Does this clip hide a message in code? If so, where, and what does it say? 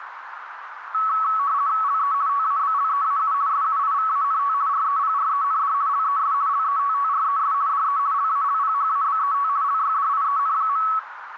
Yes: RTTY (50 baud, 170 Hz shift) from 0.9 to 11.0 s, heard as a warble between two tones, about 1210 Hz centre, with radio static and a narrow filter. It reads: LE TABLEAU SUIVANT REPREND LES LETTRES DE LALPHABET LYDIEN.